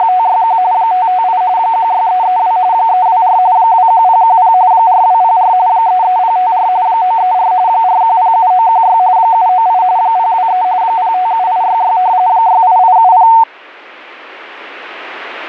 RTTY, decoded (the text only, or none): … 558 16332 324 21010 4204 33054 934 4107916 798 023 057866 68870